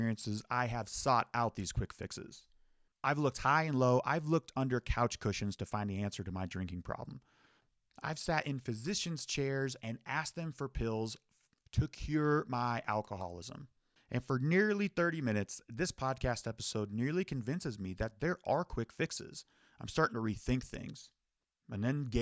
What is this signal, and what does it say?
Speech in English. There is no code.